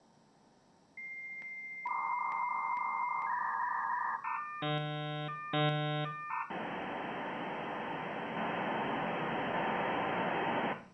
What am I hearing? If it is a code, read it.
Dial-up modem handshake (V.34 or later), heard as a whistle, warbles, then hiss, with room echo.